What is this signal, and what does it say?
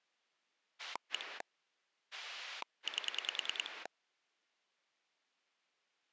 Pulse dialling, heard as a rotary dial, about 10 pulses a second. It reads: 1 8